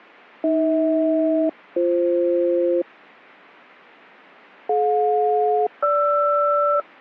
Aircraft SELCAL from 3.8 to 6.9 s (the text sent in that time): DJ-GR